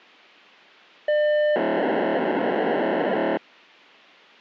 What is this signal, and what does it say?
POCSAG pager data (1200 baud), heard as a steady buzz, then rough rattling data.